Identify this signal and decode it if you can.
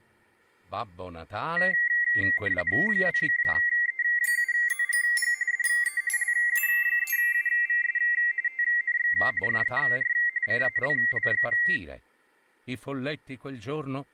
RTTY (45.45 baud, 170 Hz shift), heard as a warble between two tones, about 2000 Hz centre. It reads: 2E7ZGG DE LU3UVS TNX FER CALL.